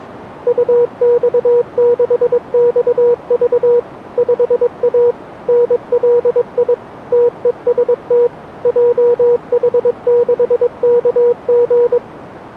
Morse code, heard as a keyed tone, machine-sent, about 22 wpm, 480 Hz, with radio static. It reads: UX6XV 5A NLI TEST JH6KG